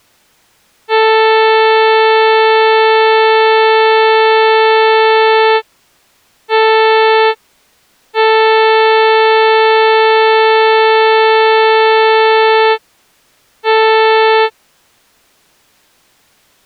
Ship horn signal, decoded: 1 long, 1 short, 1 long, 1 short

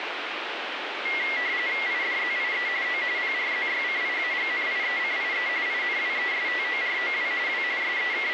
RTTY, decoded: IDZIE O PRZYCIAGNIECIE INWESTOROW W …

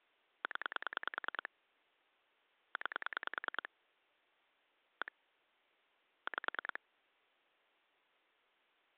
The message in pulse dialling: 0 9 1 5

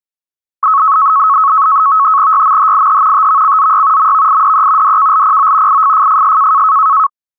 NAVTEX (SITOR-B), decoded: YMHIH TVCZY MVIDE DKLPO IFFFS

